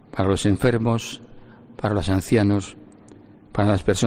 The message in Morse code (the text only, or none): none